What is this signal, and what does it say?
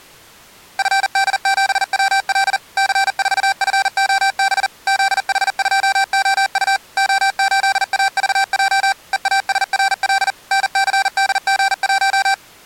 Morse code, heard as electronic beeps, machine-sent, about 40 wpm, 780 Hz. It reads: FD7WL C4FOB ZH2OU O8AVJ EASRL NCDG1